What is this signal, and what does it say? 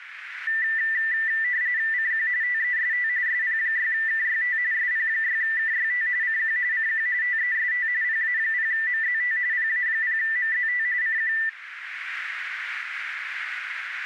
RTTY (45.45 baud, 170 Hz shift), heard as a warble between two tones, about 1900 Hz centre, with radio static. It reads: CQ TEST SP6KYT SP6KYT CQ CQ TEST PA0MZT PA0MZT CQ